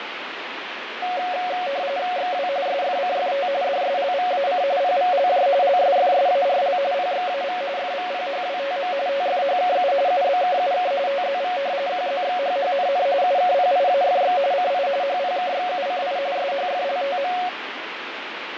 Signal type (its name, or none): RTTY